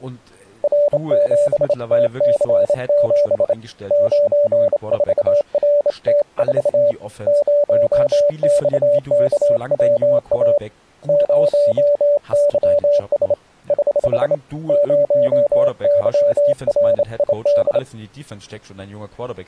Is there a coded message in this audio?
Yes: Morse code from 0.6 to 17.8 s, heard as a keyed tone, hand-sent with a straight key, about 27 wpm, 580 Hz, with speech in German. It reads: R7TC7 94RT4 0XKWA 0YS <HH> 0YRID